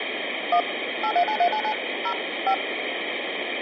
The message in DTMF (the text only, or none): 1 839399 0 5